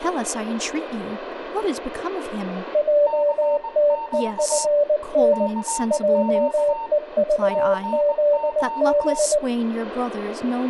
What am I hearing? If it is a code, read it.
Morse code, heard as two keyed tones, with room echo and speech in English. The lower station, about 19 wpm, 580 Hz: JTEFN JEVZB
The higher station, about 19 wpm, 910 Hz: CQ CQ CQ